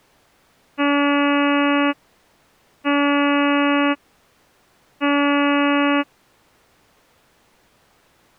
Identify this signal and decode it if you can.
Ship horn signal, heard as a ship's horn, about 290 Hz. 3 short. At sea: I am operating astern propulsion.